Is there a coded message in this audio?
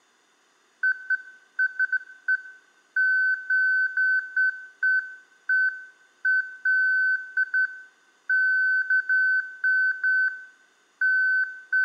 No, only beeps of irregular length, with room echo.